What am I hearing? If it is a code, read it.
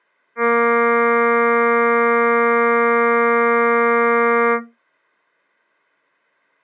Ship horn signal, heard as a ship's horn, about 230 Hz. 1 long. At sea: a vessel nearing a blind bend, or under power and making way in fog.